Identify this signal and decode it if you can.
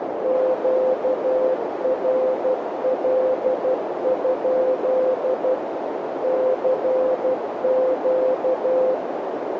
Morse code, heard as a keyed tone, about 12 wpm, 520 Hz, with heavy radio static and a narrow filter. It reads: QRL? CQ